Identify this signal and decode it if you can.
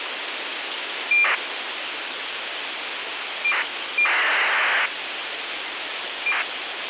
ACARS aircraft data, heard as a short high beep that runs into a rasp, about 2400 baud, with radio hiss.